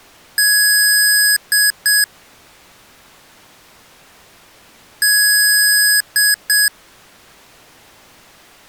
Beep code, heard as beeps from a small speaker, played twice, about 1650 Hz. 1 long, 2 short. In Award, IBM and AMI BIOS tables: video adapter failure.